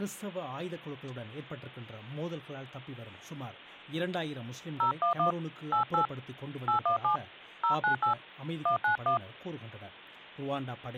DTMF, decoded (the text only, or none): 011 88 817 098 191